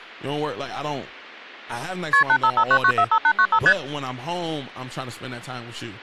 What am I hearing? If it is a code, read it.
Multi-frequency trunk signalling (R1, as on North American trunks), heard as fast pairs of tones, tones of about 70 ms, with speech in English. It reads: KP 8559945895 ST